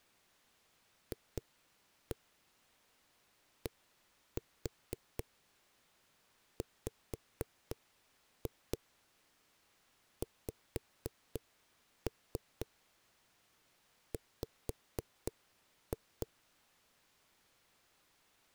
Tap code, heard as knocks on a wall, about 4 knocks a second. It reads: FDWXW